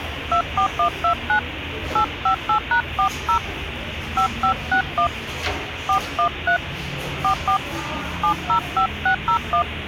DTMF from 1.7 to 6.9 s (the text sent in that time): 858#40 5561 413